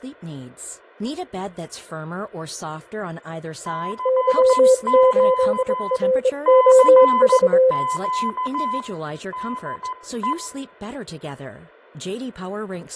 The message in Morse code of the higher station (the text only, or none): CQ CQ DE